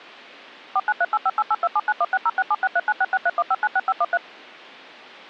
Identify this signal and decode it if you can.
DTMF, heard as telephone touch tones, dialled by machine, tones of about 40 ms. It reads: 4938588279160676396631596513